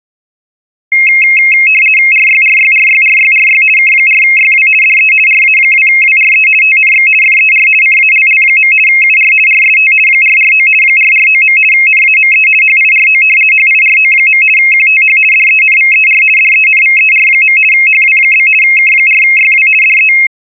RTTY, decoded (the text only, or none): RYRYRYRYRY K4YW DE RA2WRE TNX FER CALL. UR RST 449 449. NAME HIRO HIRO. QTH DENVER DENVER. HW? K4YW DE